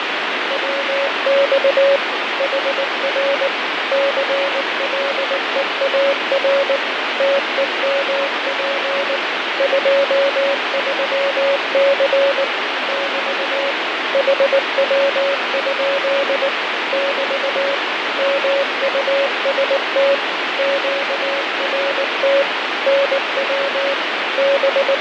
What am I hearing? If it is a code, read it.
Morse code, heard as a keyed tone, machine-sent, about 19 wpm, 560 Hz, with heavy radio static and fading. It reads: WX HR CLEAR TEMP 23C <BT> HW? <BT> MUST QRT NW …